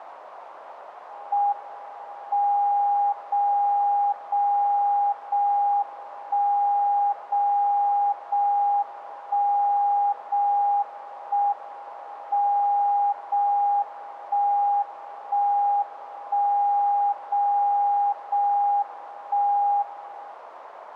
Radio time signal (JJY), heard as a tone whose level steps once a second, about 810 Hz, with radio static. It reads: M 0 0 0 1 0 0 1 0 1 M 0 1 1 1 0 0 1 1